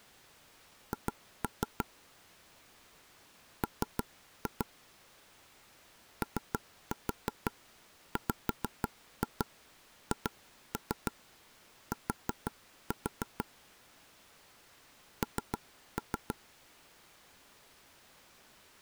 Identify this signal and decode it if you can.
Tap code, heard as taps on a table, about 6 knocks a second. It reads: H M OWHT N